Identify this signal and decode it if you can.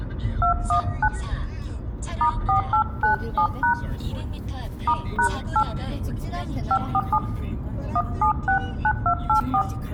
DTMF, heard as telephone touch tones, dialled by hand, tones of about 80 ms, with room echo and the noise inside a car. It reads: 219 *4897# *#8 547 1769284